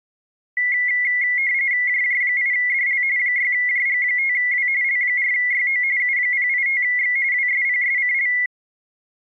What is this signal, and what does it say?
RTTY (45.45 baud, 170 Hz shift), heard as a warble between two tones, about 2050 Hz centre. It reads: JJ8DL 6JG5W L4YO U085X WSPSCL